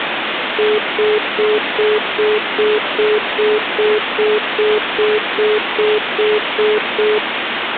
Telephone call progress tone (single-tone plan, as in most of Europe), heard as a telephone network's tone, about 420 Hz, 0.2 s on and 0.2 s off, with phone line noise. Congestion tone.